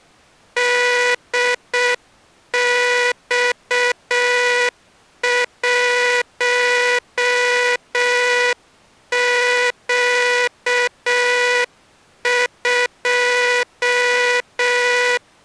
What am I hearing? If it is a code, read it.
Morse code, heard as a buzzer, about 6 wpm. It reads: DX1Q2